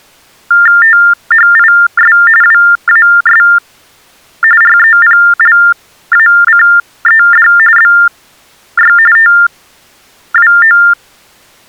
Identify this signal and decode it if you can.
TTY/TDD text telephone tones (45.45 baud Baudot), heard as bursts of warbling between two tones, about 400 Hz shift, 1600 Hz centre. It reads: THIS WAS REPLACED BY TWO